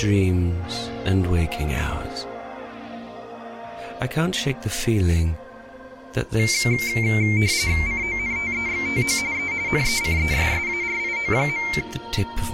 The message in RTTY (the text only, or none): CONTEXTO E NECESSARIO.